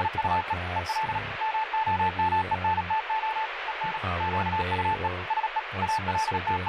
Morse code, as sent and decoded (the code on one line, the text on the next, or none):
… / . .-.. / -- --- -- . -. - --- / . -. / --.- ..- . / ... . / …
… EL MOMENTO EN QUE SE …